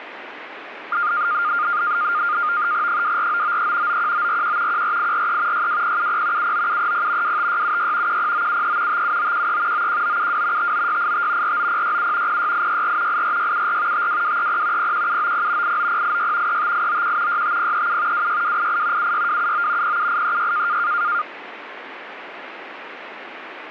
NAVTEX (SITOR-B), 100 baud, 170 Hz shift, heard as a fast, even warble, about 1310 Hz centre, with radio static. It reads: 24993 91941 14843 62070 79730 25676 10973 57913 91972 59685 49067 06864 84674 52230 01790 89086 35891 65037 26288 76279 07836